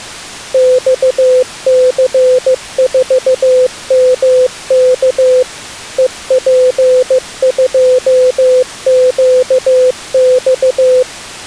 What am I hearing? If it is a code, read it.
Morse code, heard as a keyed tone, machine-sent, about 15 wpm, 510 Hz. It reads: XC4MK EP2QX